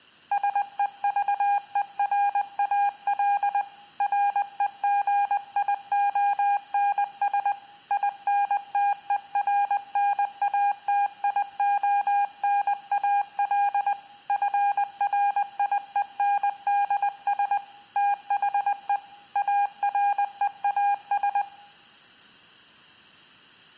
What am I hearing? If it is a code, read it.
Morse code, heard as a keyed tone, hand-sent with a paddle, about 20 wpm, 810 Hz, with room echo. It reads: SEVERAL REGIONS INTERNATIONAL FRIENDS THE AREAS